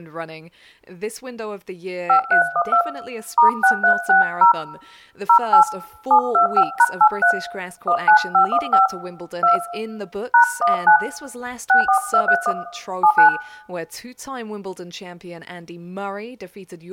DTMF, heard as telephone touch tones, dialled by hand, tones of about 90 ms, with room echo. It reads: 5312 *6360 08 725#83 19515 2 #19 64231 79